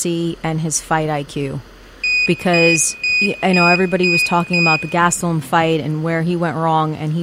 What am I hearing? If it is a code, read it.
Beep code, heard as a piezo beeper, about 2500 Hz, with room echo and speech in English. 6 short. In AMI BIOS tables: keyboard controller gate A20 failure; in Dell tables: video card failure.